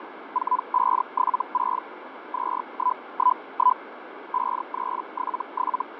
Hellschreiber (Feld-Hell, 122.5 baud), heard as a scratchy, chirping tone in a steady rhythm, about 1000 Hz, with radio static and fading. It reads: 4576 2111 5377